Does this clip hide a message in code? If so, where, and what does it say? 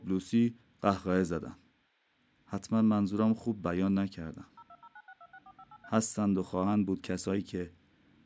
Yes: DTMF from 4.6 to 5.9 s, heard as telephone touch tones, dialled by machine, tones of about 50 ms. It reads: 02096264583